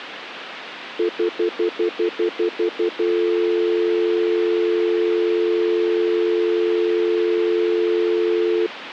Telephone call progress tone (North American plan), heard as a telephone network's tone, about 350, 440 Hz, 0.1 s on and 0.1 s off, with phone line noise. Stutter dial tone.